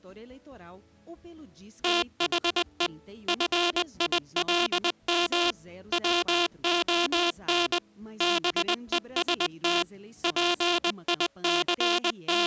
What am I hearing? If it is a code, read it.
Morse code, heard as a buzzer, machine-sent, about 20 wpm. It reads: THE FILM WON BEST …